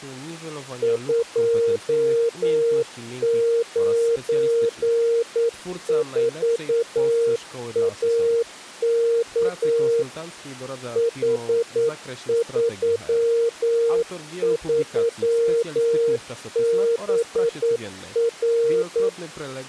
Morse code, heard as a keyed tone, machine-sent, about 9 wpm, 460 Hz, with speech in Polish. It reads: 294AK H33BR